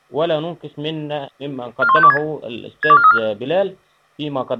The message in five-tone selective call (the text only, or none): 41526 62434